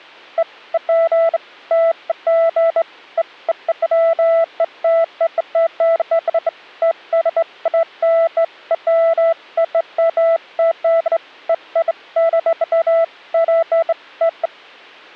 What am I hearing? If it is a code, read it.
Beeps of irregular length. There is no code.